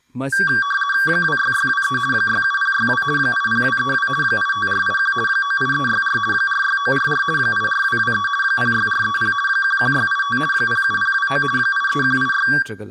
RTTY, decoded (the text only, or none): 26623 67062 80232 85481 98364 46944 84223 06430 11685 07029 83186